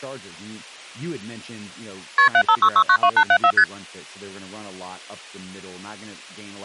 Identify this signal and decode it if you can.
Multi-frequency trunk signalling (R1, as on North American trunks), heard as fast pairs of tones, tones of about 70 ms, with speech in English. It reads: KP 756692874 ST